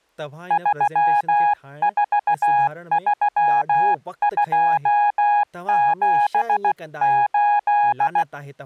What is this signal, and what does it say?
Morse code, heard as a keyed tone, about 16 wpm, 830 Hz, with speech in Sindhi. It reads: 343278